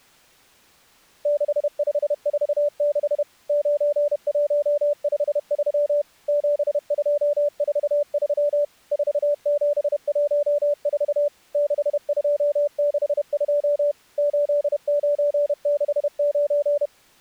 Morse code, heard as a keyed tone, machine-sent, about 31 wpm, 580 Hz. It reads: 6546 9153 7243 4714 6262 8969